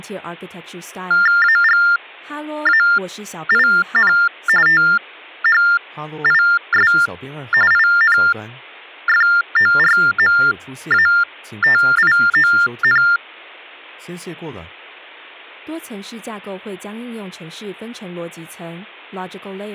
TTY/TDD text telephone tones (45.45 baud Baudot), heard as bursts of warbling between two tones, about 400 Hz shift, 1600 Hz centre, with speech in Chinese. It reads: AGAIN THIS INFORMATION